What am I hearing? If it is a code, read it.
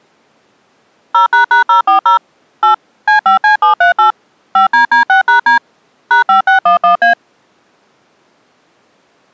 DTMF, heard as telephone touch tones, dialled by machine, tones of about 120 ms. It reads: 0##040 8 C5C738 5DD6#D #5611A